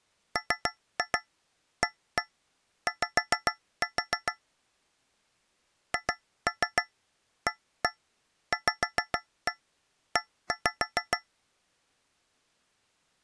Tap code, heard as taps on a metal pipe, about 6 knocks a second. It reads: MAY HAVE